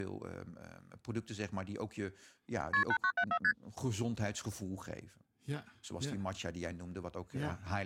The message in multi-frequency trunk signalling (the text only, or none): KP 8974 ST